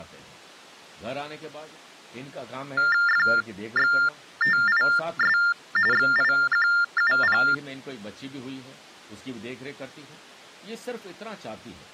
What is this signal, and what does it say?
TTY/TDD text telephone tones (45.45 baud Baudot), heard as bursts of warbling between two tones, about 400 Hz shift, 1600 Hz centre, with speech in Hindi. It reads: FXTIS XIQUP